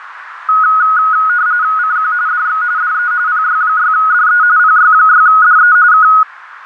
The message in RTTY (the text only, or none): CQ DX DE PY6DE PY6DE K